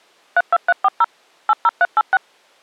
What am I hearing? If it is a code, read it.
DTMF, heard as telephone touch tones, dialled by machine, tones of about 40 ms. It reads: 32340 80386